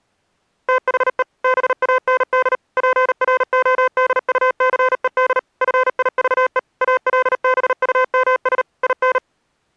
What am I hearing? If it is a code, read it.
Morse code, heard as electronic beeps, machine-sent, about 38 wpm, 510 Hz. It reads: THE BAND PRODUCED FIVE ALBUMS IN